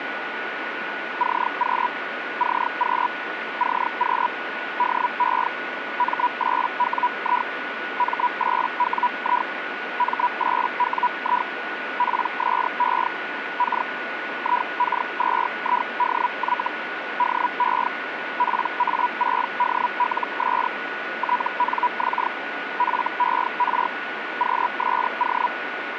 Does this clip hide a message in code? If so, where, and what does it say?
Yes: Hellschreiber (Feld-Hell, 122.5 baud) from 1.2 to 25.5 s, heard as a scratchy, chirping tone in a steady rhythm, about 980 Hz, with radio static and a steady whistle near 1460 Hz. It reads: CQ CQ CQ DE M8WI M8WI M8WI PSE K IK2IDY DE PA6DLS TNX FER QSO